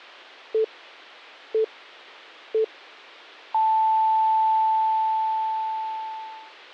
Radio time signal (three low pips and a long one an octave up, as on NHK), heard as pips.